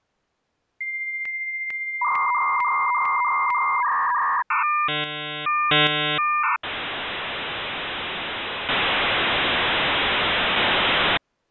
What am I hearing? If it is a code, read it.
Dial-up modem handshake (V.34 or later), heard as a whistle, warbles, then hiss.